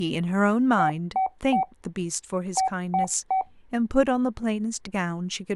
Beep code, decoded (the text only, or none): 3-3